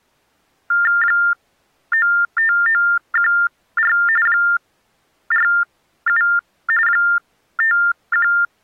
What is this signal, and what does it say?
TTY/TDD text telephone tones (45.45 baud Baudot), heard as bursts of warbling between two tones, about 400 Hz shift, 1600 Hz centre. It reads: 95914 47 51